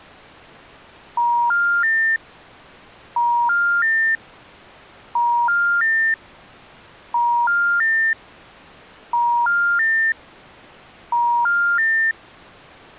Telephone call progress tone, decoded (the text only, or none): special information tone